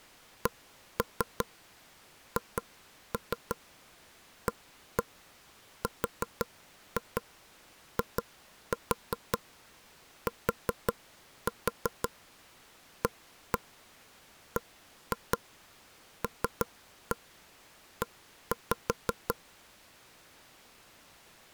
Tap code, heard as taps on a table, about 5 knocks a second. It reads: CHARITABLE